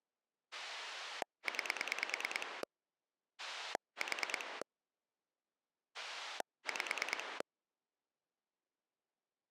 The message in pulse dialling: 9 4 5

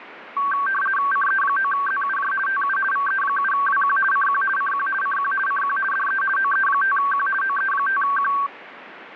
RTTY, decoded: CE9ZUJ TU VE7WQ CQ CQ CQ CQ DE OE5Q OE5Q

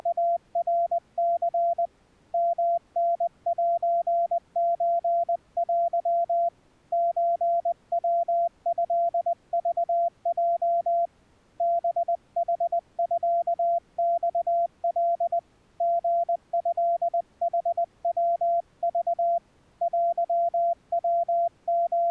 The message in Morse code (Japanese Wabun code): … ヨタセソテ ソヤトクヲ ハヌミマカ リトヌヤク …

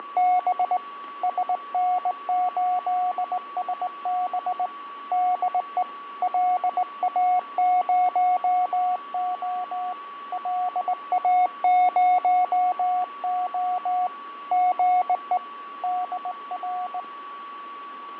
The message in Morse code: … SN8SB DE LA0O LA0O GE DR

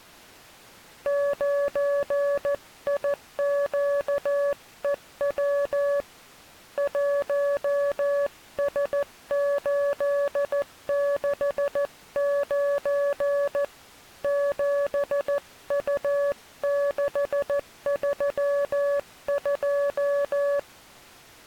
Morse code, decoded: 9IQEW 1S869 7U632

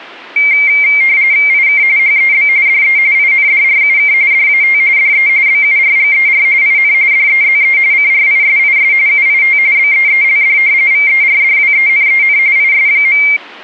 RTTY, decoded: IK HEB DE INDRUK DAT DE BURGER IN DEZE CRISIS UIT BEELD VERDWENEN IS.

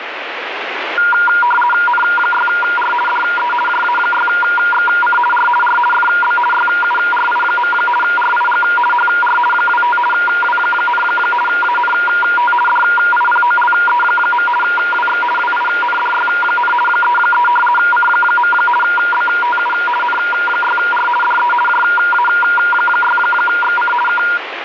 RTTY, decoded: N6R DE JA6XC R R FB YURI. RIG HR 25 W, ANT DIPOLE. WX WINDY, 33 C. BTU N6R DE JA6XC K

